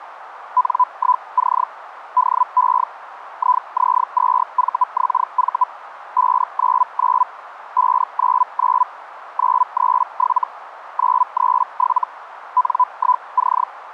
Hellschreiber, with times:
0.6-1.6 N1C
2.2-2.8 DE
3.4-5.6 IZ2VXV
6.2-7.2 599
7.8-8.8 599
9.4-10.4 937
11.0-12.0 937
12.6-13.6 N1C

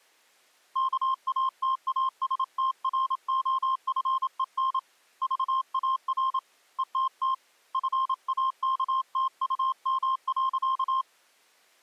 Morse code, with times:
0.8-4.8 KATASTROFEN
5.2-6.4 VAR
6.8-7.3 ETT
7.7-11.0 FAKTUM.

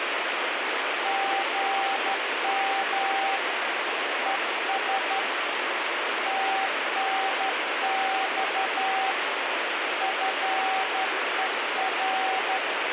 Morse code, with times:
1.1-3.4 GM
4.3-5.2 ES
6.3-9.1 TNX
10.0-12.6 FER

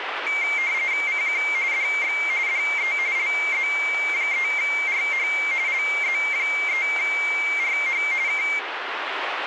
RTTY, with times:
1.1-1.4 CQ
1.7-2.2 DX
2.5-2.9 DE
3.2-5.3 LZ3RH
5.7-8.0 LZ3RH
8.3-8.4 K

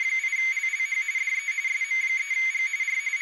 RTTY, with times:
0.0-1.0 …
1.2-1.5 DE
1.7-2.7 SM3G
2.8-3.0 R
3.2-3.2 …

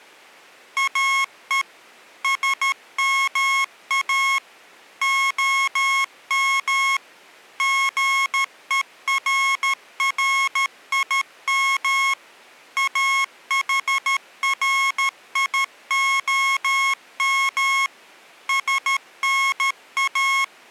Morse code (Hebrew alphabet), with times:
0.8-1.6 או
2.2-4.4 שמא
5.0-7.0 הם
7.6-12.1 גוררים
12.8-17.9 אחריהם
18.5-20.7 …

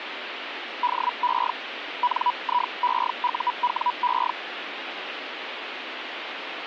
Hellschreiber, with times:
0.8-1.5 DE
2.0-4.3 NIEUWE

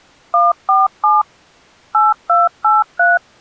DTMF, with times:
0.3-1.2 147
1.9-3.2 8283

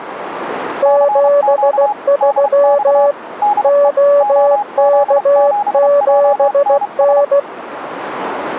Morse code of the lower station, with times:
0.8-3.1 73
3.6-7.4 OK7N

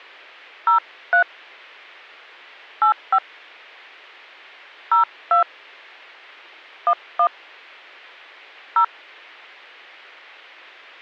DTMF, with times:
0.7-1.2 03
2.8-3.2 85
4.9-5.4 02
6.9-7.3 11
8.8-8.8 0

